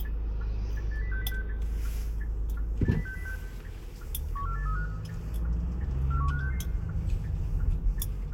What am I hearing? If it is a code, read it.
Five-tone selective call (CCIR), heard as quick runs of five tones, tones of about 100 ms, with a squelch burst at the end, room echo and the noise inside a car. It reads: 80606 80606 14835 41566